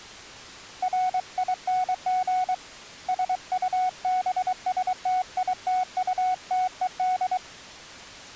Morse code, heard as a keyed tone, hand-sent with a paddle, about 23 wpm, 740 Hz. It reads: RING SUBSTITUTED